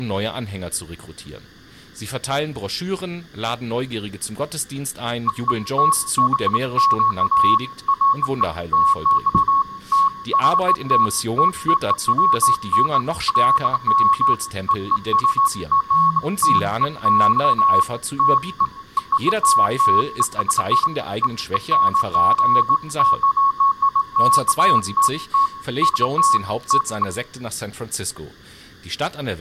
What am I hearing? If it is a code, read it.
Beeps of irregular length, with room echo and speech in German. There is no code.